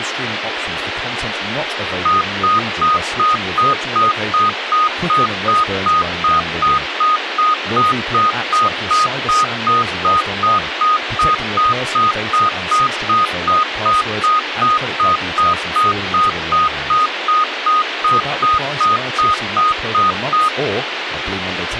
Evenly repeated beeps, with radio hiss and speech in English. There is no code.